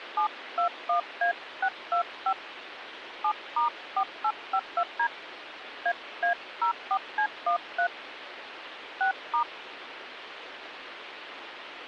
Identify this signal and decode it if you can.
DTMF, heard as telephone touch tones, dialled by hand, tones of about 100 ms, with phone line noise. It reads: 721A625 7*4852D AA04C13 6*